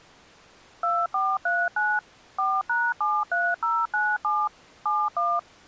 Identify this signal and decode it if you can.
DTMF, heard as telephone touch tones, dialled by machine, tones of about 230 ms. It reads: 2439 4#73097 71